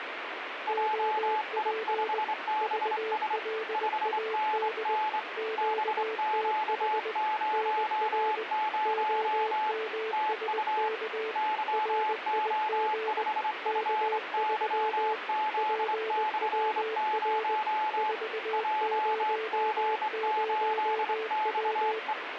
Morse code, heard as two keyed tones, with radio static. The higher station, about 25 wpm, 860 Hz: JI5BS 5NN BQ00 TU YO5FYZ/0 JG8XE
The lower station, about 20 wpm, 440 Hz: OP VLAD QTH NR OMSK RIG K3 PWR 400W